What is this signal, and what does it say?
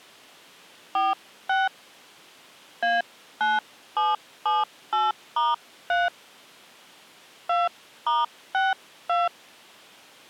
DTMF, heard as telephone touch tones, dialled by hand, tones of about 180 ms. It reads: 46 A9778*3 2*62